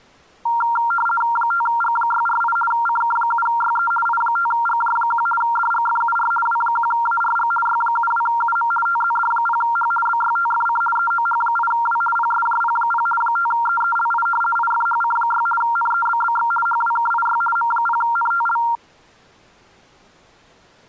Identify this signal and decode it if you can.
RTTY (50 baud, 450 Hz shift), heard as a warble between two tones, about 1160 Hz centre. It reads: 5G648 CK7YE I5GJ1 DGFUR W1ARG Y72UM TZD0H BYTFC EOH8W PSJP0 5EELI IFHC6 NEBBX HWKIY M0NTL